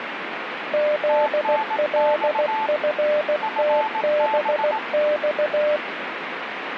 Morse code, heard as two keyed tones, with radio static. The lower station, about 16 wpm, 600 Hz: ZLFTBX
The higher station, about 18 wpm, 880 Hz: TNX FB